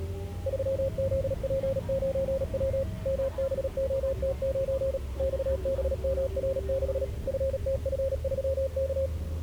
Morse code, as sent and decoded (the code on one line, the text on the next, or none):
...-- --.. .--. ----. .-- / -- -... --- - ----. / -..- -... -- .-. -.... / ..-. - ..-. ...-- -.-
3ZP9W MBOT9 XBMR6 FTF3K